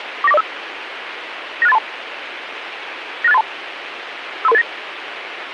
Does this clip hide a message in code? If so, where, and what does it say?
Yes: five-tone selective call (EIA) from 0.2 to 4.6 s, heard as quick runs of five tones, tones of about 30 ms, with radio hiss and a squelch burst at the end. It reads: 49405 96832 96832 53389